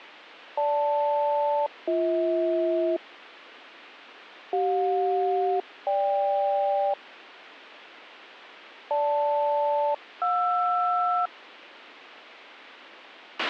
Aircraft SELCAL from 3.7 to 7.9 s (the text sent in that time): CJ-GK